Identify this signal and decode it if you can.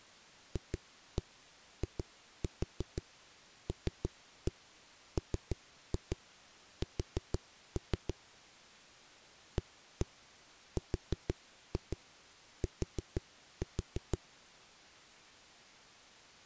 Tap code, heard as knocks on a wall, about 6 knocks a second. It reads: FILMS ART